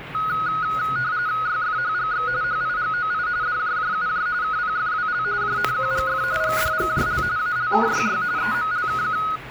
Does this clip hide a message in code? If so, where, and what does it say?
Yes: RTTY (45.45 baud, 170 Hz shift) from 0.1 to 9.4 s, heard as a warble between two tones, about 1360 Hz centre, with radio static and the noise inside a lift. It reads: YFHGX HIGOI DJJUJ KPFWL JNQGF GDGJL ALKYY EMLKQ